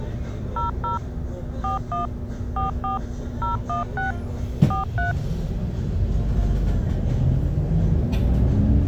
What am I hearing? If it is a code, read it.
DTMF, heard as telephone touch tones, dialled by machine, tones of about 140 ms, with the noise inside a bus. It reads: 00 41 44 016 43